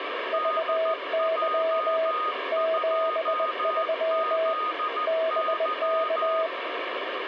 Morse code, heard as two keyed tones, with radio static. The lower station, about 20 wpm, 650 Hz: VY 73 BK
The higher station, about 14 wpm, 1240 Hz: DJ2ZY